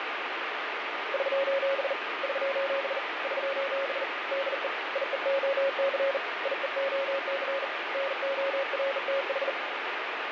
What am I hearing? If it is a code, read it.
Morse code, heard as a keyed tone, hand-sent with a bug key, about 40 wpm, 550 Hz, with heavy radio static. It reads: <SOS> <SOS> <SOS> DE IEOC IEOC NORTH